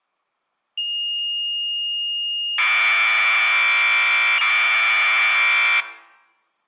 Commodore tape loading (standard loader), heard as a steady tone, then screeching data, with room echo.